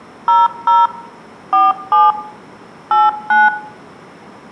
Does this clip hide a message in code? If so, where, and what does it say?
Yes: DTMF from 0.3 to 3.5 s, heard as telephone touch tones, dialled by machine, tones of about 190 ms, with room echo. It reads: 00 47 89